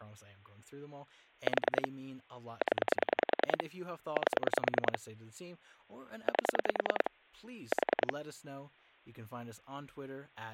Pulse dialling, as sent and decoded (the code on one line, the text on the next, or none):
4 / 10 / 8 / 8 / 4
4 0 8 8 4